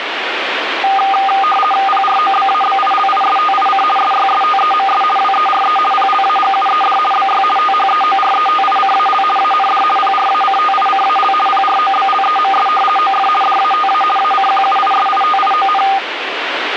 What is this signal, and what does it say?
RTTY (50 baud, 450 Hz shift), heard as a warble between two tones, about 1010 Hz centre, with radio static. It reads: PROBABILISTIC SYSTEMS WERE PLAGUED BY THEORETICAL AND PRACTICAL PROBLEMS OF DATA ACQUISITION